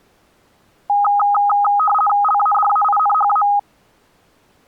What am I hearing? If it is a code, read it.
RTTY (50 baud, 450 Hz shift), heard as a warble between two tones, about 1040 Hz centre. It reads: LADAINHA